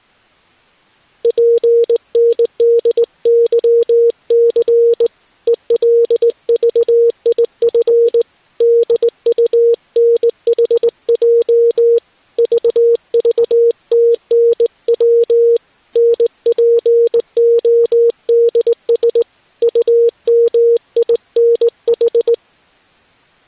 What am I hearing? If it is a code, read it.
Morse code, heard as a keyed tone, hand-sent with a straight key, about 19 wpm, 470 Hz. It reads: PNDYC ELVIF DUNHJ VVTNW NPODS UMINH